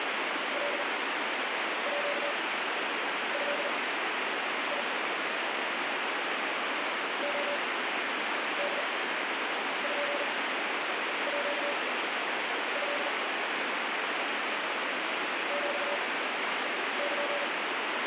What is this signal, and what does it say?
Morse code (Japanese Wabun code), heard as a keyed tone, machine-sent, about 40 wpm, spaced as for 8 wpm, 580 Hz, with heavy radio static. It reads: カード レポート ヒル